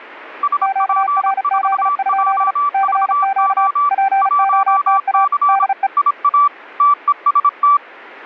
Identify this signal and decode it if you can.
Morse code, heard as two keyed tones. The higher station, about 26 wpm, 1160 Hz: SP4JVO 1C IA TEST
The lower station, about 35 wpm, 780 Hz: QRZ? CQ POTA DE